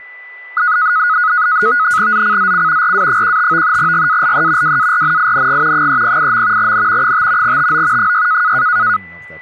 NAVTEX (SITOR-B), 100 baud, 170 Hz shift, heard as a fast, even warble, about 1360 Hz centre, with a steady whistle near 1990 Hz and speech in English. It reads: ZCZC RA15 GALE WARNING 308. N 5 TO 6